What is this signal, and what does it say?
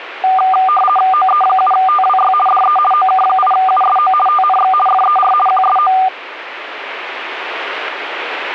RTTY (50 baud, 450 Hz shift), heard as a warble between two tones, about 980 Hz centre. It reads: OE7TWY DE OK8USO TNX FER QSO